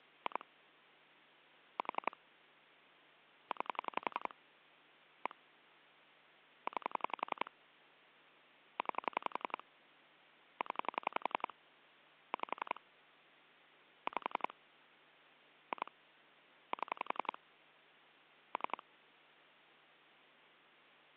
Pulse dialling, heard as clicks on a phone line, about 11 pulses a second. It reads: 2 4 9 1 9 9 0 5 5 2 7 3